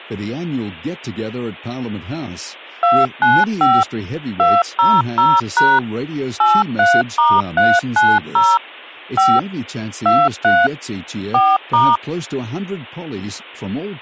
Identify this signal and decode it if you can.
DTMF, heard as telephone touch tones, dialled by machine, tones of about 220 ms, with speech in English. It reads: 295 200# 83*390 5 23 4*